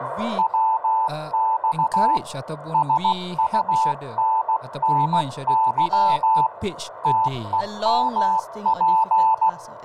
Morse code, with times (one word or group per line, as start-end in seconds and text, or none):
0.4-2.2 WX
2.7-6.5 SUNNY
7.0-9.5 TEMP